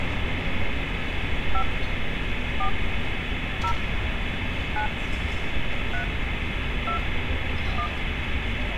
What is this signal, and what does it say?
DTMF, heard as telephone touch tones, dialled by hand, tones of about 80 ms, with phone line noise and street noise. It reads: 5 4 0 9 3 2 1